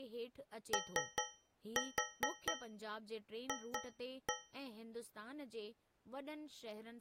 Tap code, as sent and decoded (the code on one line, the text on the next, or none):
3-4 2-1
OF